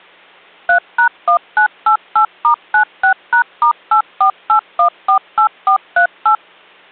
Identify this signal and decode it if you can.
DTMF, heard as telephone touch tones, dialled by machine, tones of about 100 ms. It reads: 3#1988*96#*848148438